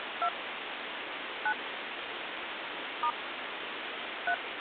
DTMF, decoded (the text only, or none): 2 9 * 3